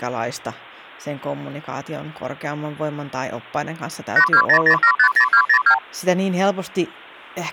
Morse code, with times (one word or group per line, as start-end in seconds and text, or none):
none